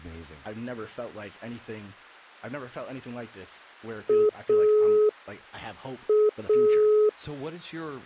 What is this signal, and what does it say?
Telephone call progress tone (pulsed, as in Italy), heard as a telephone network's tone, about 420 Hz, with speech in English. Dial tone.